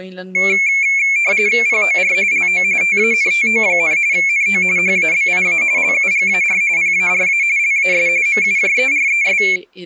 RTTY (45.45 baud, 170 Hz shift), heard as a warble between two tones, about 2300 Hz centre, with speech in Danish. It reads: POR LO TANTO, NO HABIA LUGAR PARA LAS MUJERES